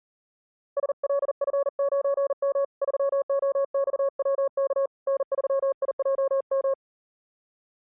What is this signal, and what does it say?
Morse code, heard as a keyed tone, hand-sent with a paddle, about 40 wpm, 550 Hz. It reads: SLF9M 3OXWK N3IJM